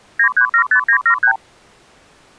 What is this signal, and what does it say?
Multi-frequency trunk signalling (R2, with the far end's replies), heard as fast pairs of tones, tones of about 90 ms. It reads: 9375973